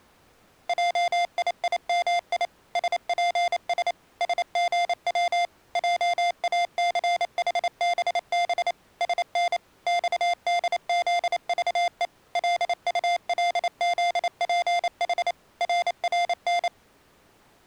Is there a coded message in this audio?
Yes: Morse code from 0.6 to 16.7 s, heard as electronic beeps, machine-sent, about 28 wpm, 700 Hz. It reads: JIIMI SPS SGW JACHBB SN XDZVE LULZPH RRN